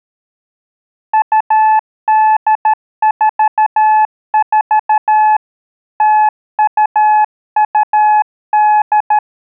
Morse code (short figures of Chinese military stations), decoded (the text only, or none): 2844 0228